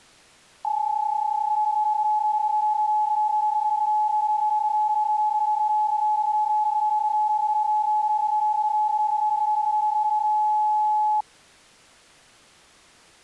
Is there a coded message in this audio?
Yes: PSK31 (31.25 baud) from 0.6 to 11.2 s, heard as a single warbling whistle, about 850 Hz.